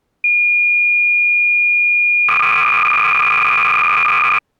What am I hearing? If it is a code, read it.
Cassette data (Kansas City type), 300 baud, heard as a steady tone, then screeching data.